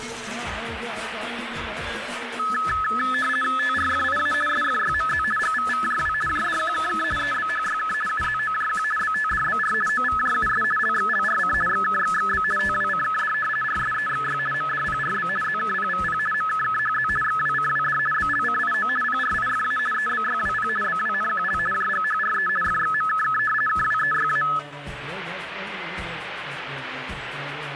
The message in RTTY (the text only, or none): TRFIA SFYMZ GVVJW JDQKK EBHYK UZOJQ BTDBR OVJUS LXLRC XKXXB TWCKD RSEXY MDPRB ZKPVP MKKHZ XWCWD BLCIO PRIFA EBYWP BWNQL JGHRE FXMKK KWEYA